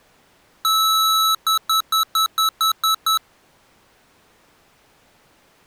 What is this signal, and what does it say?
Beep code, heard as beeps from a small speaker, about 1300 Hz. 1 long, 8 short. In AMI BIOS tables: display or retrace test failure.